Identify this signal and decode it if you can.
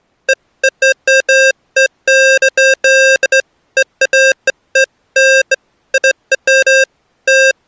Beeps of irregular length. There is no code.